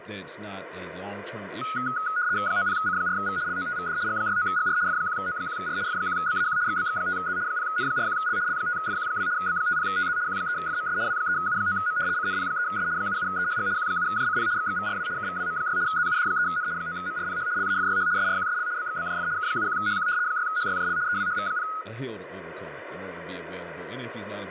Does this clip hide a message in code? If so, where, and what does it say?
Yes: RTTY (75 baud, 170 Hz shift) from 1.6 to 21.8 s, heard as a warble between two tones, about 1360 Hz centre, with radio static and speech in English. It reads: 90C4V LOTVD G69GR F1O1R F1BAQ XBX5Z 0N41L L5FQ2 B50TZ Q3FMS W3U9M CNP3S 77EHG Q7JCP XXVRW KVWM6 ZUD3N 9MRPH LAFYH SRQSL BXBJF K71HQ 6HYJL EWHV0